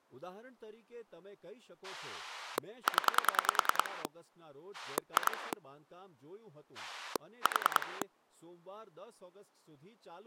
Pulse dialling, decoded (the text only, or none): 0 2 4